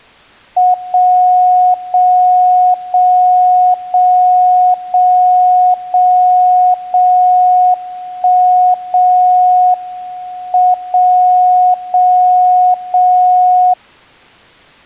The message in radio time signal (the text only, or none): 0 0 0 0 0 0 0 1 0 M 0 0 0